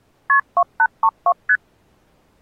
Multi-frequency trunk signalling (R1, as on North American trunks), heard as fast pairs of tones, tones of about 60 ms. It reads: KP 2832 ST